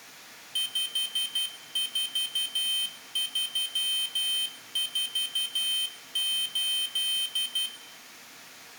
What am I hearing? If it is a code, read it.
Morse code, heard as a high beeper, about 12 wpm, 3100 Hz, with room echo. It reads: 54348